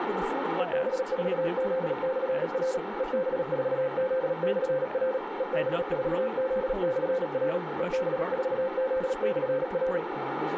Morse code, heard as a keyed tone, machine-sent, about 37 wpm, 520 Hz, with radio static, a narrow filter and speech in English. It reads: EB4Z/R EB4Z/R EB4Z/R EB4Z/R